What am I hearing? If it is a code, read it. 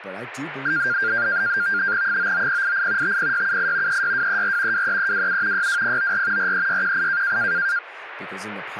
NAVTEX (SITOR-B), 100 baud, 170 Hz shift, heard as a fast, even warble, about 1500 Hz centre, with radio static and speech in English. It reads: 99088 50678 36234 23327 62094 43618